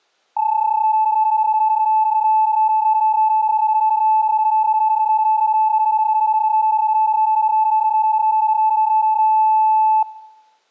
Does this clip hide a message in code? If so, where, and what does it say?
Yes: PSK31 (31.25 baud) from 0.4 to 10.0 s, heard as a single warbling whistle, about 870 Hz.